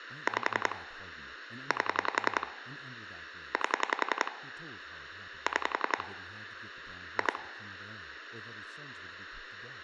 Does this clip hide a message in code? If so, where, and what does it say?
Yes: pulse dialling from 0.3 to 7.4 s, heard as clicks on a phone line, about 11 pulses a second, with speech in English. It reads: 5 8 8 6 2